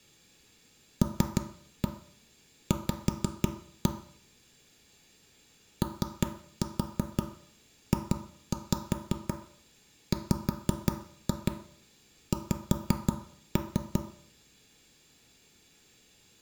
Tap code, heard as knocks on wood, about 5 knocks a second, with room echo. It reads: LV OJWX